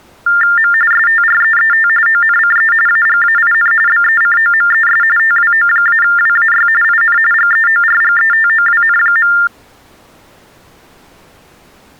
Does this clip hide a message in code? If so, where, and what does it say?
Yes: TTY/TDD text telephone tones (45.45 baud Baudot) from 0.3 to 9.5 s, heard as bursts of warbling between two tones, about 400 Hz shift, 1600 Hz centre. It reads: M STREET ONCE AGAIN BECOMES TWO-WAY IN GEORGETOWN.